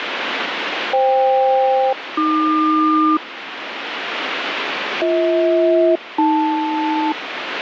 Aircraft SELCAL, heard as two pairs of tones, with radio static. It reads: FK-AQ BH-AL